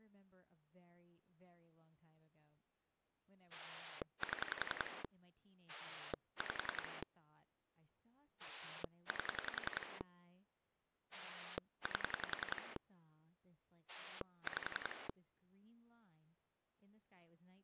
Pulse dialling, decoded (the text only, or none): 7 5 8 8 5